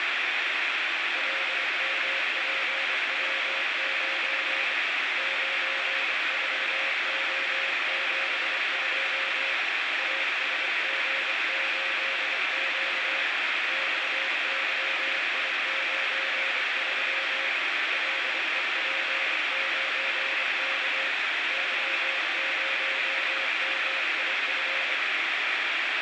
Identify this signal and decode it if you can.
Morse code, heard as a keyed tone, hand-sent with a straight key, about 25 wpm, 540 Hz, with heavy radio static. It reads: LMPW9 94O72 ASG8Q XYI93 LEP9K Y0MIF